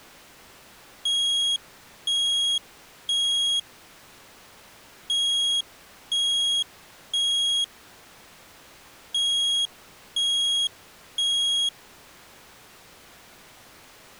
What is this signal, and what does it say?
Alarm pattern, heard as an alarm's beeps, played three times, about 3300 Hz. Temporal three. Smoke or fire, evacuate.